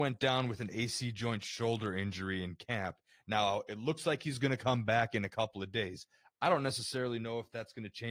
Speech in English. There is no code.